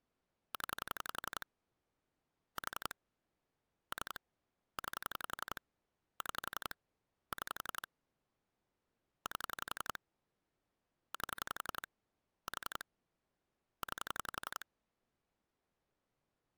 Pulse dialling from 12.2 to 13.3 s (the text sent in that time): 4